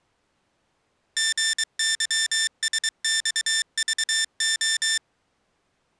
Morse code, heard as electronic beeps, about 23 wpm, 1800 Hz. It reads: GYSXVO